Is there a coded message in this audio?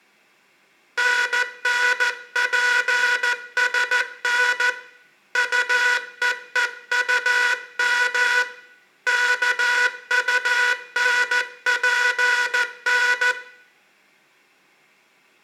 Yes: Morse code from 0.9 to 13.4 s, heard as a buzzer, hand-sent with a paddle, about 14 wpm, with room echo. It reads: NNPSN UEEUM KUNPN